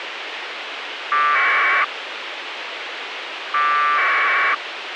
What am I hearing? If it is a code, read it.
Packet radio (AX.25, as in APRS), 1200 baud, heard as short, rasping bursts, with radio hiss and a squelch burst at the end.